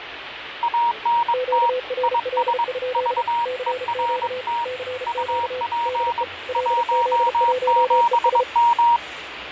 Morse code, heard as two keyed tones, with radio static, fading and the noise of a subway station. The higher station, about 22 wpm, 940 Hz: ANT IS VERT UP 17M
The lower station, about 34 wpm, 510 Hz: QRL? CQ CQ DE LZ1ES